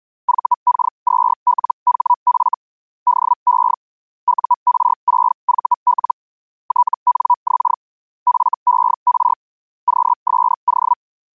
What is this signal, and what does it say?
Hellschreiber (Feld-Hell, 122.5 baud), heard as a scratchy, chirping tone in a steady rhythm, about 980 Hz. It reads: VK2LHF DE UR6VL TNX FER QSO